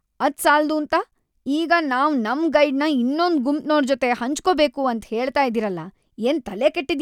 Speech in Kannada. There is no code.